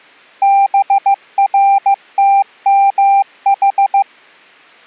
Morse code, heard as a keyed tone, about 15 wpm, 790 Hz. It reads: BRTMH